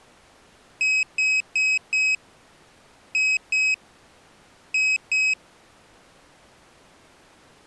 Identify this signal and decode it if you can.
Beep code, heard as a piezo beeper, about 2550 Hz. 4-2-2. In Phoenix BIOS tables: shutdown test failure.